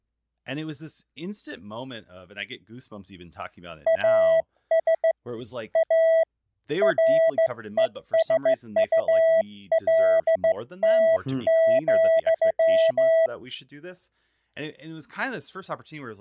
Morse code, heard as a keyed tone, hand-sent with a straight key, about 15 wpm, 650 Hz, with speech in English. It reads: AS A RESULT,